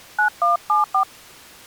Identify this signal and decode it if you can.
DTMF, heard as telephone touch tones, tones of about 130 ms. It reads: 9174